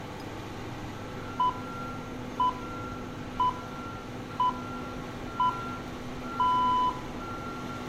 Radio time signal (six pips, as the Greenwich Time Signal), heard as pips, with room echo and street noise.